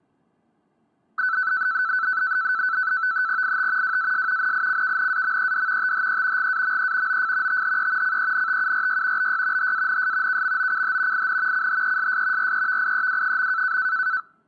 NAVTEX (SITOR-B), 100 baud, 170 Hz shift, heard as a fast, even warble, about 1420 Hz centre. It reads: IT WAS NICKNAMED THE GAME OF THE CENTURY BY HANS KMOCH IN CHESS REVIEW.